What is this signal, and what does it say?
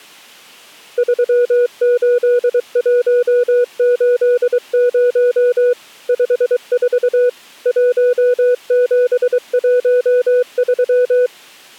Morse code, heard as a keyed tone, machine-sent, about 23 wpm, 490 Hz. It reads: 38180 54 1713